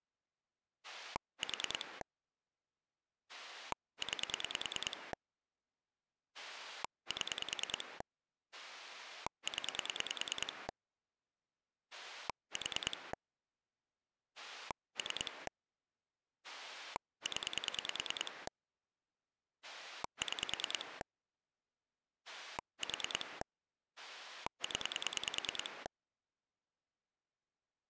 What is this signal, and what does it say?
Pulse dialling, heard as a rotary dial, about 10 pulses a second. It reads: 4 9 7 0 4 3 0 6 4 0